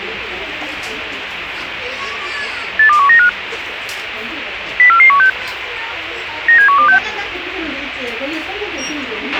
Five-tone selective call (CCIR), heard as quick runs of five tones, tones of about 100 ms, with radio hiss, a squelch burst at the end and the noise of a crowd indoors. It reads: 82195 04416 97126